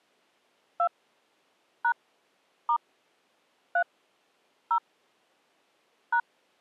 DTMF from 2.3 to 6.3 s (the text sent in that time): * 3 0 #